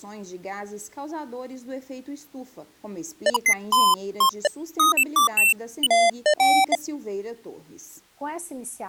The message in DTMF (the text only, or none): none